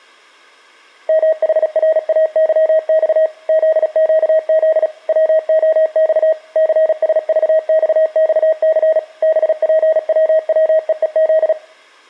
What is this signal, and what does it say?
Morse code, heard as a keyed tone, machine-sent, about 36 wpm, 630 Hz, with room echo. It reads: MHRAYX ZQZ WOX CSVXXC BPWWEEZ